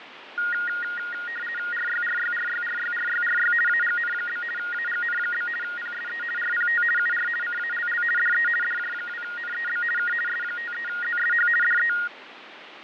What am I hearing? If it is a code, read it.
RTTY (50 baud, 450 Hz shift), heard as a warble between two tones, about 1650 Hz centre, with radio static and fading. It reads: RYRYRYRYRYRY AGN? AGN? PSE RPT UR CALL DE DJ2NEB K S53ZSH DE